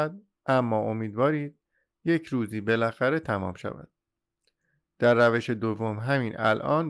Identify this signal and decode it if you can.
Speech in Persian. There is no code.